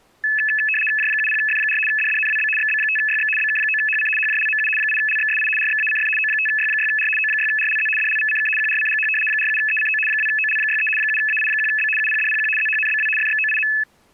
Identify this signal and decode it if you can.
RTTY (75 baud, 850 Hz shift), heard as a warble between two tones, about 2150 Hz centre. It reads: J70F4 DDNWB XB5YX BK9HC HJLMU 8LXSI RXACF O5Y6R O6RLZ DLVCK QRCGH 47ECO 2OL63 7AI1B UPDPQ ZHNBW FXOIM